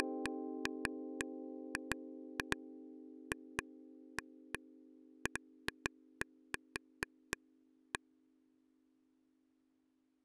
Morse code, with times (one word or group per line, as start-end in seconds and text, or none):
none